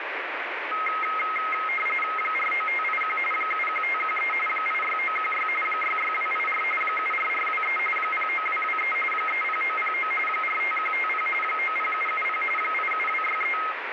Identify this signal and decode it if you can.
RTTY (45.45 baud, 850 Hz shift), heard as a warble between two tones, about 1700 Hz centre, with radio static. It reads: 49581 71513 86916 66284 74423 09223 30909 45150 90770 87263